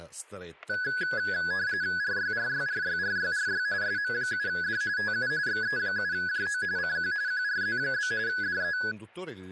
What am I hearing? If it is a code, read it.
RTTY (45.45 baud, 170 Hz shift), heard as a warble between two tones, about 1600 Hz centre, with static crashes and speech in Italian. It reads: RYRYRYRYRY SM7D TU XE7JO CQ QRZ? DE